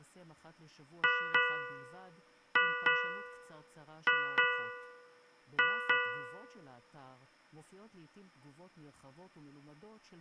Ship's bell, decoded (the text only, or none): 8